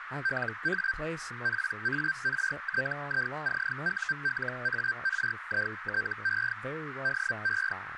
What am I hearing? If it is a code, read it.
Hellschreiber (Feld-Hell, 122.5 baud), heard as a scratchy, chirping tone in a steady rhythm, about 1550 Hz, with radio static, a narrow filter and speech in English. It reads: LA PARTICULARITE DE